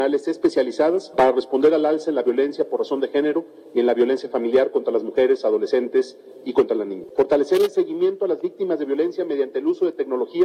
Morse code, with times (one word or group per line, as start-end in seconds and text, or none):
none